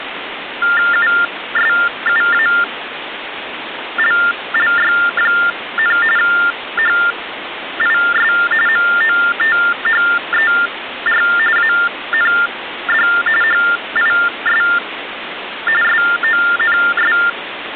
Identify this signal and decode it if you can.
TTY/TDD text telephone tones (45.45 baud Baudot), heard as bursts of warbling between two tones, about 400 Hz shift, 1600 Hz centre, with phone line noise. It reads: USUALLY, HIS MOTHER AND HIS SONS